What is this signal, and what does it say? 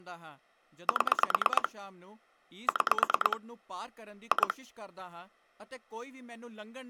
Pulse dialling, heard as clicks on a phone line, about 9 pulses a second, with speech in Punjabi. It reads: 7 6 2